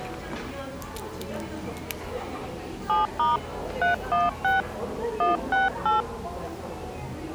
DTMF, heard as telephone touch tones, dialled by hand, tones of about 150 ms, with the noise of a cafe. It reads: 7* 316 168